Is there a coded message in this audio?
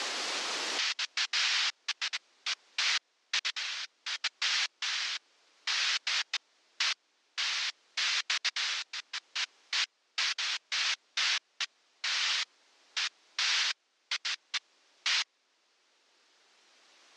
No, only bursts of noise.